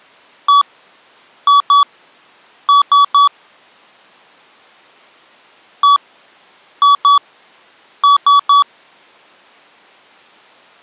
Beep code, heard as beeps from a small speaker, played twice, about 1140 Hz. 1-2-3. In Phoenix BIOS tables: DMA page register failure.